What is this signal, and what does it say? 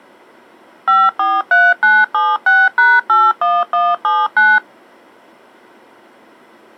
DTMF, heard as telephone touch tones, dialled by machine, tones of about 220 ms. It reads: 543976#81179